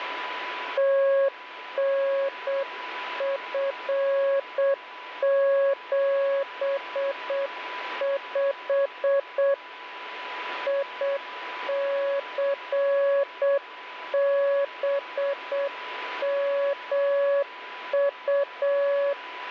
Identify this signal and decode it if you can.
Morse code, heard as a keyed tone, hand-sent with a paddle, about 7 wpm, 560 Hz, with radio static and a steady whistle near 990 Hz. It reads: TNF75 ICBMU